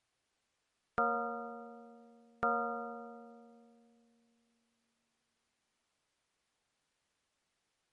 Clock strike, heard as a bell. 2. Two o'clock.